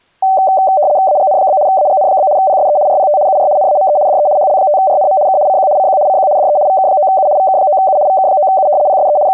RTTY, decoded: AGN? AGN? PSE RPT UR NAME DE HL5RNM K CQ CQ CQ DE VK9U VK9U VK9U PSE …

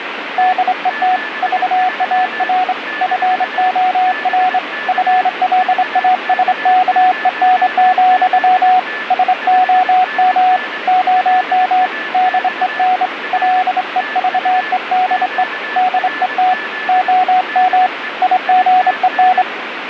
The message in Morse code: DET VAR FOR FLASKEN, SOM OM DEN LEVEDE DET OM IGEN

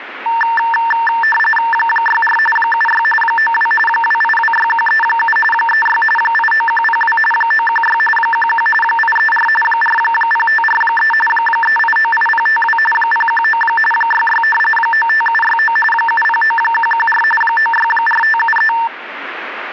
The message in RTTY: 64 76 92 2826137 36 89102 916 11 834 40543 3898052 019 66 95769 709114 964573

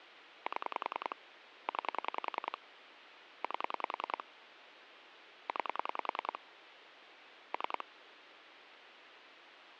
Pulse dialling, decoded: 7 9 8 9 3

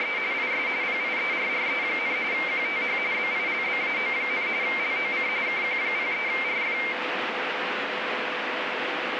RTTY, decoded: … IS PIERRE, QTH BILBAO, LOC KQ03RF

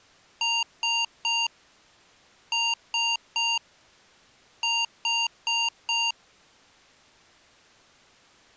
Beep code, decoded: 3-3-4

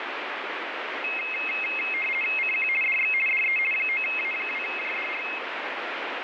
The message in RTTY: CQ DX DE 9A2JDR

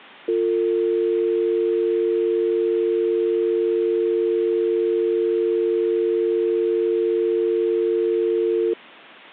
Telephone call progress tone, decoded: dial tone

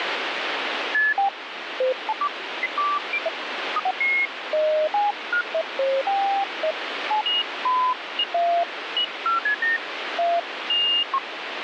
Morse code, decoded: none

